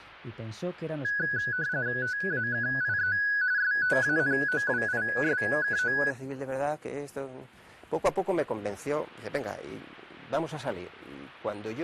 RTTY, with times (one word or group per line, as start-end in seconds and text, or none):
2.0-3.2 TAKIE
3.6-6.0 STANOWISKO